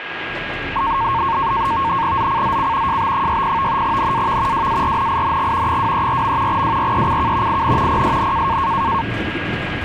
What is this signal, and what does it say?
NAVTEX (SITOR-B), 100 baud, 170 Hz shift, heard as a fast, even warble, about 1000 Hz centre, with radio static, a steady whistle near 1640 Hz and the noise inside a bus. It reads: ZCZC JB60 NAV WARNING 234. WRECK IN PSN